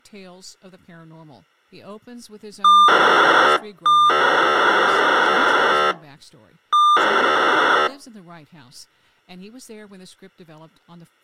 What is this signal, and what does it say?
POCSAG pager data (2400 baud), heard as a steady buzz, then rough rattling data.